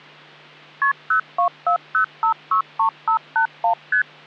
Multi-frequency trunk signalling (R1, as on North American trunks), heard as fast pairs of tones, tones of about 100 ms, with hum. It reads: KP 0240563581 ST